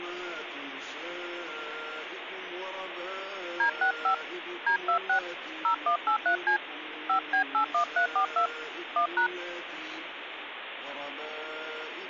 DTMF, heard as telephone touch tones, dialled by hand, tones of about 100 ms, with phone line noise. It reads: D65 D26 0183C 5B81342 1#